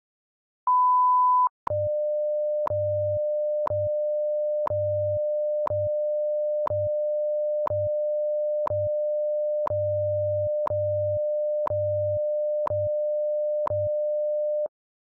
Radio time signal (WWV, Colorado), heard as ticks, one a second.